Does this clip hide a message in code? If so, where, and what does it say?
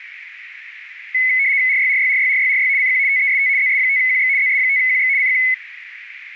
Yes: RTTY (75 baud, 170 Hz shift) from 1.1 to 5.5 s, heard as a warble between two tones, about 2100 Hz centre, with radio static. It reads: RYRYRYRYRY CQ TEST ZS5QX ZS5QX CQ